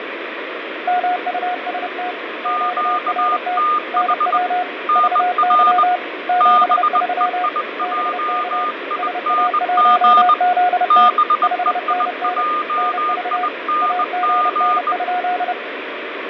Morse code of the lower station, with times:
0.9-2.1 MUST
2.4-3.6 QRT
3.9-4.6 NW
5.0-6.0 VY
6.3-7.5 73
7.8-8.6 BK
9.0-11.1 SA1ZT
11.4-12.4 5NN
12.8-13.5 NV
13.8-15.5 AGN?

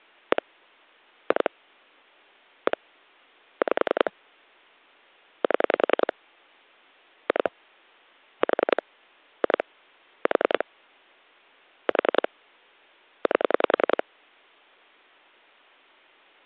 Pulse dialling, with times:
0.3-0.4 1
1.3-1.5 2
2.7-2.8 1
3.6-4.1 5
5.4-6.1 7
7.3-7.5 2
8.4-8.8 4
9.4-9.6 2
10.3-10.6 4
11.9-12.3 4
13.3-14.0 8

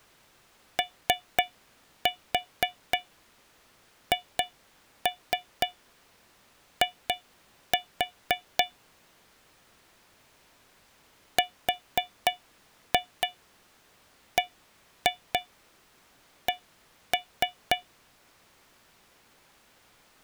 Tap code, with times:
0.8-8.6 OHI
11.4-17.8 RBC

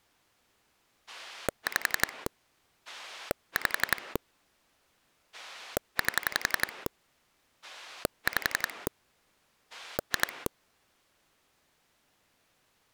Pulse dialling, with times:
1.1-2.3 5
2.9-4.2 5
5.3-6.9 8
7.6-8.9 5
9.7-10.5 2

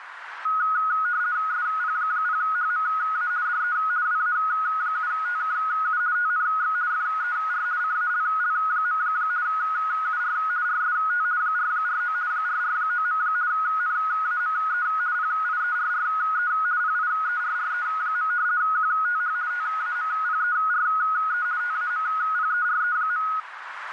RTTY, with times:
1.5-3.3 SP0HMA
3.5-3.8 DE
4.1-6.0 WA7TKU
6.2-6.8 TNX
6.9-7.7 FER
7.8-9.0 CALL.
9.5-10.4 UR
10.7-11.3 RST
11.4-12.2 449
12.3-13.2 449.
13.5-14.9 NAME
15.2-16.5 PIERRE
16.8-18.3 PIERRE.
18.6-19.4 QTH
19.5-21.5 TAMPERE
21.6-23.3 TAMPERE.

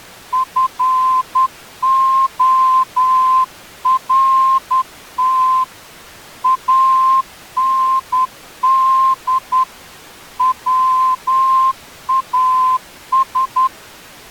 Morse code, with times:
0.3-5.6 FORT
6.4-9.6 AND
10.4-13.7 WAS

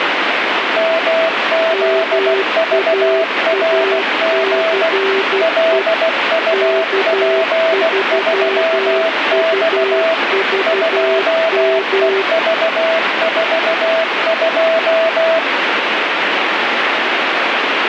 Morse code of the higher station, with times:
0.8-4.9 MZVRG
5.4-10.1 LUP3X
10.7-15.4 2EV42

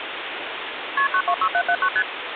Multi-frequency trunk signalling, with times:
1.0-1.1 KP
1.1-1.9 926779
2.0-2.0 ST

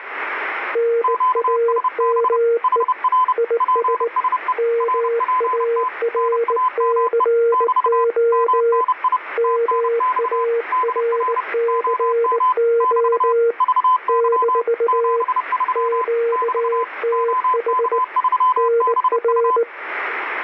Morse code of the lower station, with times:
0.8-2.8 NAME
3.4-4.1 IS
4.6-8.8 MARCO
9.4-13.5 MARCO
14.1-15.2 -
15.8-18.0 QTH
18.6-19.6 NR

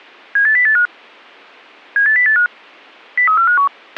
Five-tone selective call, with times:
0.4-0.9 78085
2.0-2.5 78085
3.2-3.7 03451

